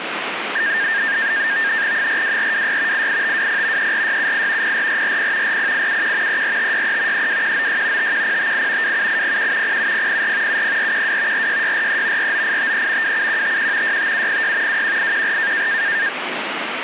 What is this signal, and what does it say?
NAVTEX (SITOR-B), 100 baud, 170 Hz shift, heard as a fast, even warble, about 1700 Hz centre, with radio static. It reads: 42426 88520 34678 04440 40871 34563 32196 51058 27801 07004 70412 46643 49853 27151 65706 21814